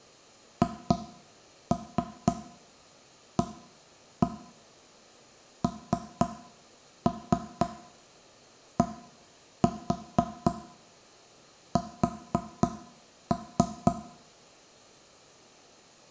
Tap code, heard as knocks on wood, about 4 knocks a second, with room echo. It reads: HANDS